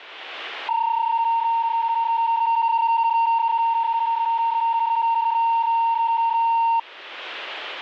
PSK31 (31.25 baud), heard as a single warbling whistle, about 920 Hz.